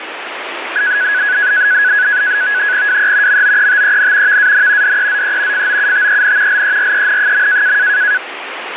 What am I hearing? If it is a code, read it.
NAVTEX (SITOR-B), 100 baud, 170 Hz shift, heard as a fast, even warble, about 1600 Hz centre, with radio static. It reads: WE MOETEN VAN DEZE FOUTEN LEREN.